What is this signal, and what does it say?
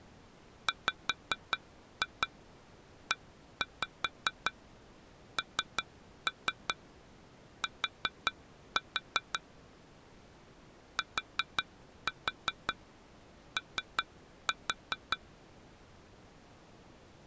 Tap code, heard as taps on glass, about 5 knocks a second. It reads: WENT TO